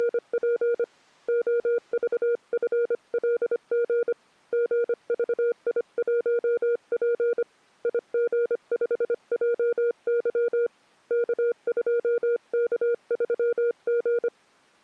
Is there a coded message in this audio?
Yes: Morse code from 0.0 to 14.3 s, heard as a keyed tone, hand-sent with a paddle, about 25 wpm, 470 Hz. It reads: … OVFLG GVI1P IG5JY K2K3G